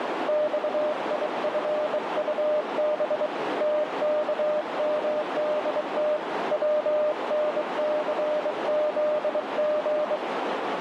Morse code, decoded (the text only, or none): XIFUB TKMDT WNCZG